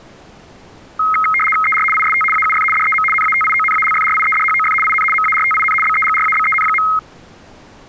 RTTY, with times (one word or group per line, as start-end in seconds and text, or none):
1.6-1.8 ER
1.9-2.2 IST
2.3-2.6 AUF
2.7-3.0 DEM
3.1-4.7 NATIONALFRIEDHOF
4.8-5.0 IN
5.1-5.7 MARTIN
5.8-6.8 BEGRABEN.